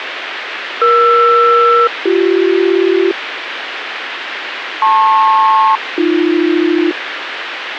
Aircraft SELCAL, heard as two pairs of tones, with radio hiss. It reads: ER-BC LP-AB